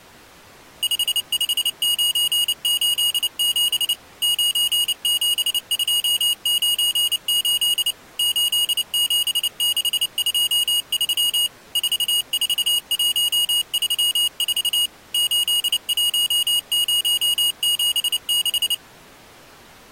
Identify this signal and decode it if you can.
Morse code, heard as a high beeper, machine-sent, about 29 wpm, 2900 Hz. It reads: 55987 97298 87623 44134 81076